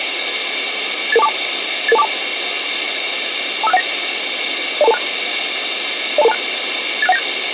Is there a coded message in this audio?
Yes: five-tone selective call (EIA) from 1.1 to 7.2 s, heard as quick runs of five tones, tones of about 30 ms, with radio hiss. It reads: 88242 88242 25619 02226 02226 86197